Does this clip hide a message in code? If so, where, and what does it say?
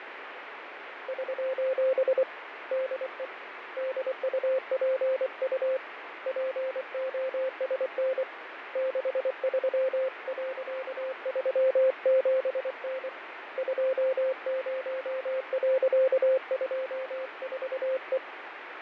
Yes: Morse code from 1.0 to 18.2 s, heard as a keyed tone, hand-sent with a paddle, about 24 wpm, 520 Hz, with radio static and fading. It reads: <SOS> DE DUPU POSN 63.37N 20.24E